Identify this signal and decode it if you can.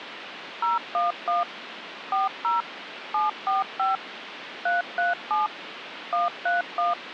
DTMF, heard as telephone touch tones, dialled by machine, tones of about 160 ms, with phone line noise. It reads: 011 40 745 337 131